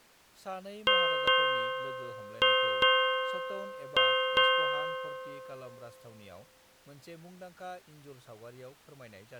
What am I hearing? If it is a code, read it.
Ship's bell, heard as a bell, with speech in Bodo. 6. Six half-hours of the watch have passed.